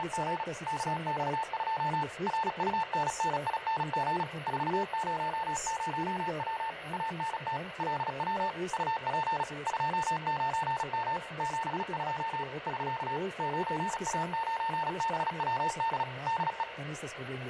Morse code, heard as a keyed tone, machine-sent, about 36 wpm, 900 Hz, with radio static and room echo. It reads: … KX2 RUNNING 400W ANT LW UP 29M 72 <SK> 9A9BWD DE